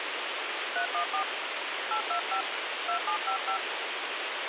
DTMF, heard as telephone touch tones, dialled by hand, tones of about 100 ms, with radio hiss. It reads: 314 825 2755